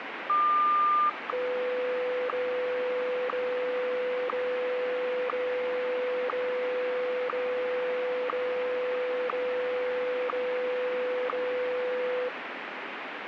Radio time signal (WWVH, Hawaii), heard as ticks, one a second, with radio static.